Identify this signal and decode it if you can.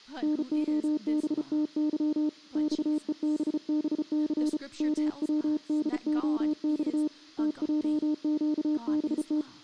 Morse code, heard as a keyed tone, hand-sent with a bug key, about 34 wpm, 300 Hz, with speech in English. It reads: NOBTY XEBBC MWDOX TJQBT